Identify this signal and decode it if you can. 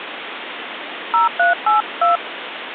DTMF, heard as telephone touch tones, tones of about 140 ms, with phone line noise. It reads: 0382